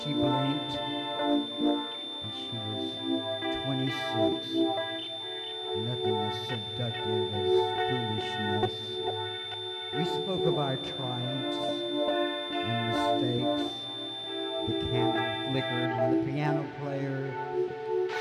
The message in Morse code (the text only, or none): none